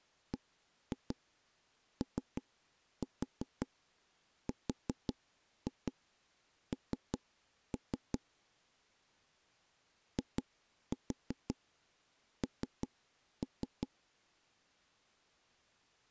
Tap code, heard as knocks on wood, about 5 knocks a second. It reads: BORN IN